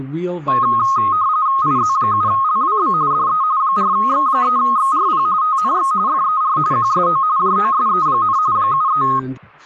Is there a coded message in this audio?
Yes: RTTY (45.45 baud, 170 Hz shift) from 0.5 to 9.2 s, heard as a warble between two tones, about 1170 Hz centre, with speech in English. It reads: IZ7LWB DE 4X3XRP TNX FER QSO JOSE, 73